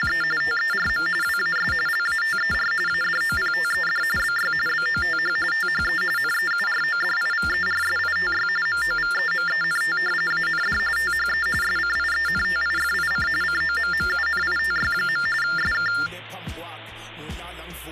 TTY/TDD text telephone tones (45.45 baud Baudot), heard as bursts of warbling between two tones, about 400 Hz shift, 1600 Hz centre. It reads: … TERM WAS LATER ADOPTED BY BOTH THE NEURODIVERSITY MOVEMENT AND THE SCIENTIFIC COMMUNITY. SK